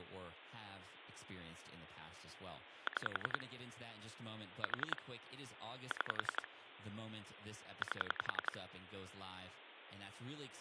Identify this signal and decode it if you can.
Pulse dialling, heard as clicks on a phone line, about 11 pulses a second, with phone line noise and speech in English. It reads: 6 4 6 8